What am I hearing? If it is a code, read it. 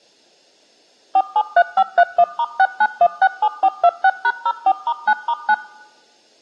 DTMF, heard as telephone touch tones, dialled by machine, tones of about 60 ms. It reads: 473531*69167426#04*9*9